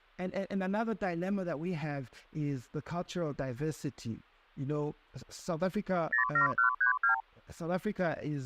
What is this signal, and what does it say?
Multi-frequency trunk signalling (R2, with the far end's replies), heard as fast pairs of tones, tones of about 110 ms, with speech in English. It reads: 07132